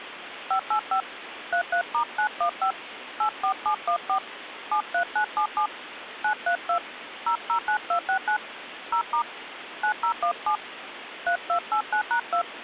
DTMF, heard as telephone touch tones, dialled by hand, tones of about 90 ms, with phone line noise. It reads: 585 33*915 84714 73977 932 009269 0* 9017 3289#2